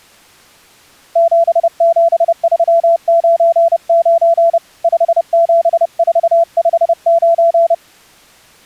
Morse code, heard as a keyed tone, hand-sent with a paddle, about 30 wpm, 670 Hz. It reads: 77399 57459